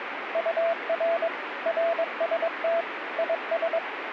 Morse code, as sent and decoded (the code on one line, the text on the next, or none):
..- .-. / .-. ... - / .. ...
UR RST IS